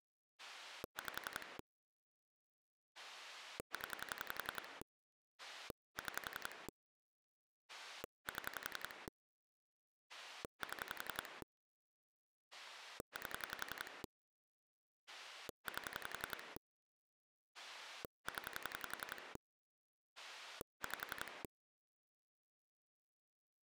Pulse dialling, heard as a rotary dial, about 11 pulses a second. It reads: 5 0 6 7 7 8 8 0 5